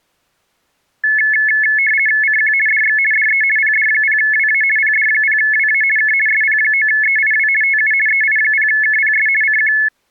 RTTY (50 baud, 450 Hz shift), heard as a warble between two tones, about 1950 Hz centre. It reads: CQ DX DE PD0WA PD0WA K SP9EIW TU EI0KPS CQ